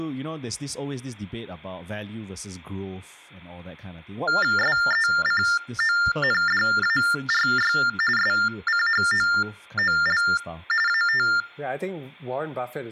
TTY/TDD text telephone tones (45.45 baud Baudot), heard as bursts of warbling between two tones, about 400 Hz shift, 1600 Hz centre, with speech in English. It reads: SECONDARY SCHOOL AT